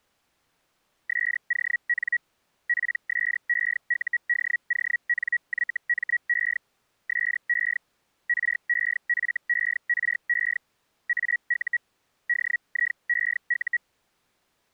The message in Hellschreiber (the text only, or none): SON PSEUDONYME SE REFERE AU DIEU